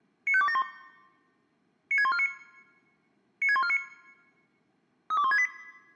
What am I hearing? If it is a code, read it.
Five-tone selective call (ZVEI), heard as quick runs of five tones, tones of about 70 ms. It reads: 95271 96149 96149 32168